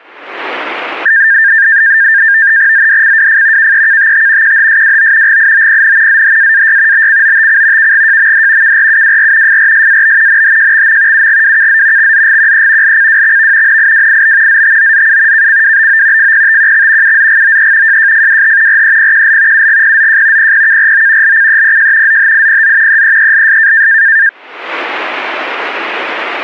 NAVTEX (SITOR-B), 100 baud, 170 Hz shift, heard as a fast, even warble, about 1700 Hz centre. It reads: ZDCWF KEKTT QHSWO GIOPN ZHAAY BCOTC KGJMD KRUWR FRSAB NHJXM UGWKZ XZGQE LCWXV NIWIB ZTOZU KCWBO FPTQX UZGOE JJFWH REPQL UGPZJ PPKRO LCEPJ ZHIPZ EEELS